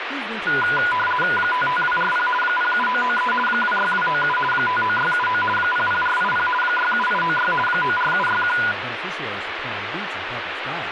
RTTY (50 baud, 450 Hz shift), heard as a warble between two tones, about 1220 Hz centre, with radio static and speech in English. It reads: 55240 07993 26297 59679 00480 67896 94761